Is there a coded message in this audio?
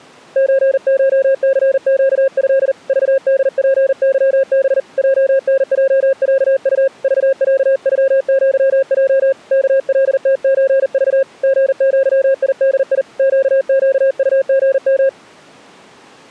Yes: Morse code (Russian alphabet) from 0.3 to 15.2 s, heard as a keyed tone, hand-sent with a paddle, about 40 wpm, 540 Hz. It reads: ЧШЦЩЭ ЖДПЫБ ЙНЙЯУ ЖЯЮЪЙ КЛТЧЖ ГЪИДИ ЩЩУГМ